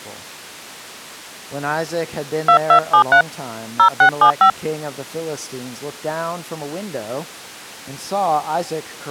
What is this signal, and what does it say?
DTMF, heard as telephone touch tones, dialled by hand, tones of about 90 ms. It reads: 2273 0675